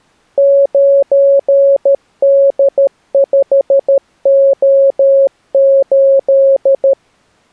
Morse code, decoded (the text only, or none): 9D5O8